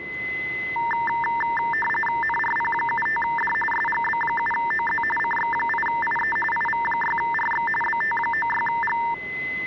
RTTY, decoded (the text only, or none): NRP75D SGB7OZ CX8IE IV6RX BT96G